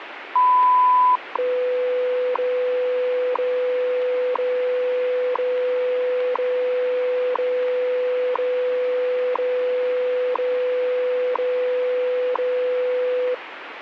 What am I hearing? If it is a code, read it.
Radio time signal (WWV, Colorado), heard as ticks, one a second, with radio static.